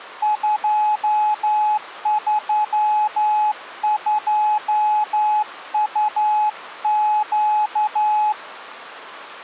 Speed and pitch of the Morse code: 11 wpm, 850 Hz

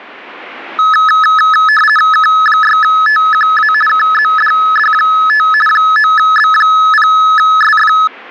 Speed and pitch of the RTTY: 50 baud, 450 Hz shift, 1500 Hz centre

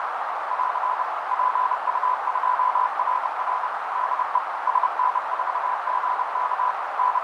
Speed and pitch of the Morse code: 30 wpm, 1000 Hz

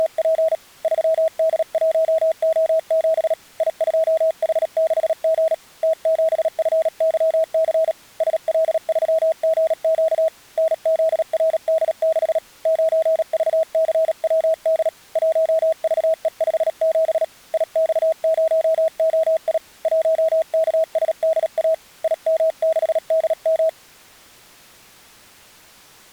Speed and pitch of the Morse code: 37 wpm, 640 Hz

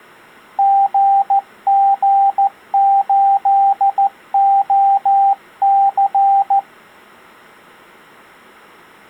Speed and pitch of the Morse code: 14 wpm, 790 Hz

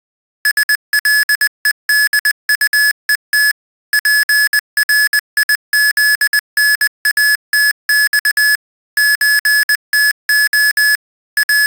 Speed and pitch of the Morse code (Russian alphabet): 20 wpm, 1700 Hz

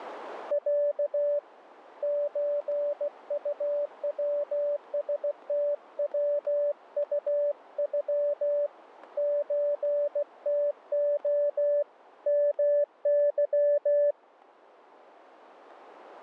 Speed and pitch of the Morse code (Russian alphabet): 16 wpm, 580 Hz

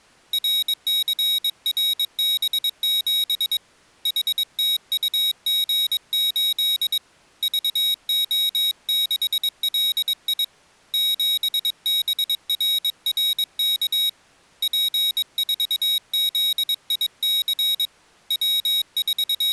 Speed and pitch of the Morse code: 22 wpm, 3800 Hz

